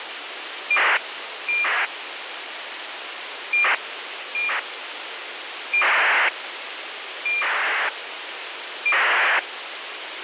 ACARS aircraft data, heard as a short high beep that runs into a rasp, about 2400 baud, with radio hiss.